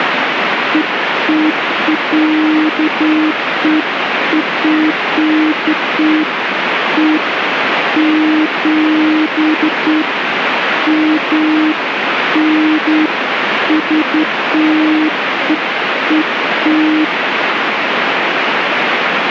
Beeps of irregular length, with radio static. There is no code.